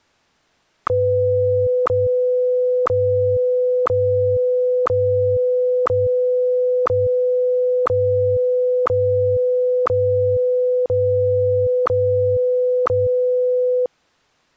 Radio time signal (WWVH, Hawaii), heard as ticks, one a second.